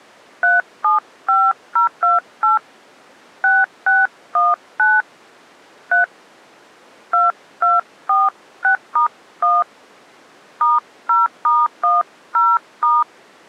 DTMF, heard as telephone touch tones, dialled by hand, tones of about 170 ms. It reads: 375028 6619 3 2246*1 *0*10*